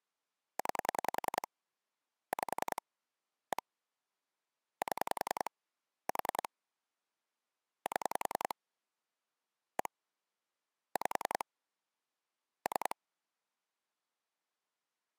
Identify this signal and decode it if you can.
Pulse dialling, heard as clicks on a phone line, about 10 pulses a second. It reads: 9 5 1 7 4 7 1 5 3